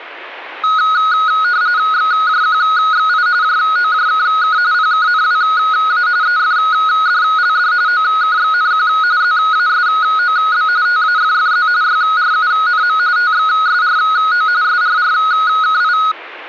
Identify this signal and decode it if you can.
RTTY (45.45 baud, 170 Hz shift), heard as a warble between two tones, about 1360 Hz centre, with radio static. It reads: XJQXI JOJKK PKNWA EFDLD OKXNQ ZASOB TAFFZ YRUNM TXSRO SRRKI